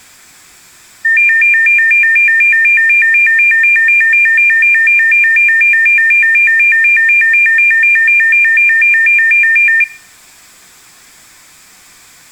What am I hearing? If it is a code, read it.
A tone that alternates evenly between two pitches, with room echo. There is no code.